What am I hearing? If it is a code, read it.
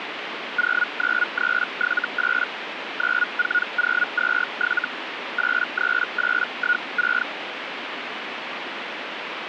Hellschreiber (Feld-Hell, 122.5 baud), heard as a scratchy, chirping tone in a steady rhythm, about 1450 Hz, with radio static. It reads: 09378 94027 83816